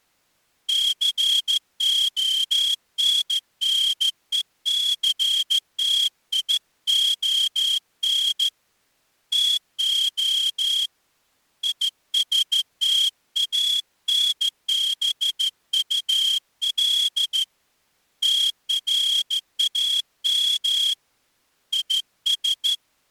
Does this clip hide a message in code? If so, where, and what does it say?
Yes: Morse code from 0.6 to 22.8 s, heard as a whistle, hand-sent with a straight key, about 14 wpm. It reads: CONNECTION TO ISTANBUL TRAM IS